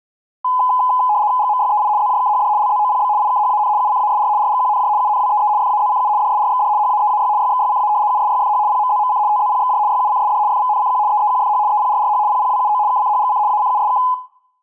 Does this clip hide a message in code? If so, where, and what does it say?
Yes: RTTY (75 baud, 170 Hz shift) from 0.4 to 14.1 s, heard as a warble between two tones, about 920 Hz centre. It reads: GMYEI ZJKHD LZOPB IKHAN UCASR RGQNJ UNWEE FAZCU DSRXD HAEAY YXYCA USYFH PMZMC TZPXJ YUCSD FVNCQ EEQFH EPRRH PPWUO KCHGC ACUSK